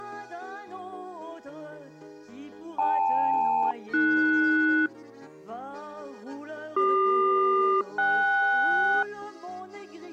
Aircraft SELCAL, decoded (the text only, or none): KL-AS CQ-KS